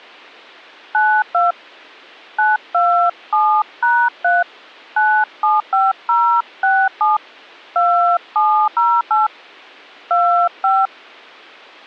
DTMF, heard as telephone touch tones, dialled by hand, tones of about 290 ms. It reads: 92 927#3 975067 2708 25